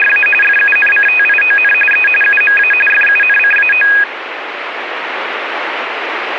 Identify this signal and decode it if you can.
RTTY (45.45 baud, 850 Hz shift), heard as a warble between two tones, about 2050 Hz centre, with radio static. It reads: … FUNCTION E UMA FUNCAO